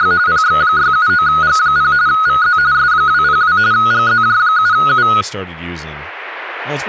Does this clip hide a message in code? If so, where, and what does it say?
Yes: RTTY (45.45 baud, 170 Hz shift) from 0.0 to 5.2 s, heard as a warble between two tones, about 1360 Hz centre, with static crashes and speech in English. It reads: … PX679G0 VZ S202 GZJ7U